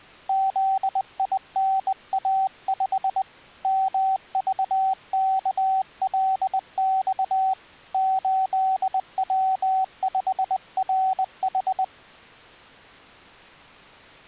Morse code, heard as a keyed tone, hand-sent with a bug key, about 20 wpm, 760 Hz. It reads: ZINA5 MVKLX 8W5RH